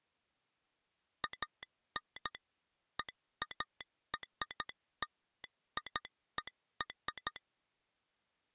Morse code (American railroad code), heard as a telegraph sounder, machine-sent. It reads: AN EARLIER